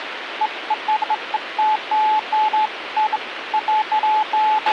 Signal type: none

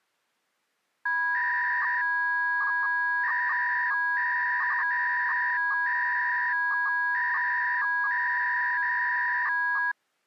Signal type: 300-baud modem data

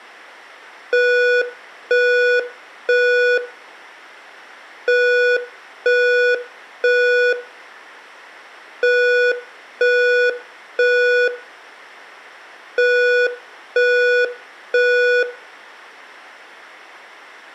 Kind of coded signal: alarm pattern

